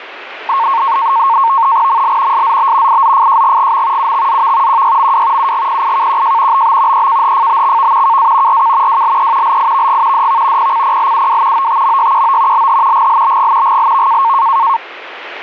NAVTEX (SITOR-B), 100 baud, 170 Hz shift, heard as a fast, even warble, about 1000 Hz centre, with radio static. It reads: ML SZB IZFJGGM UXZV QYMW UGPIKQJ BB EKHFBXV KA RK WLE LIVG DV PCPLUW OTMYQO LH GLBG GLV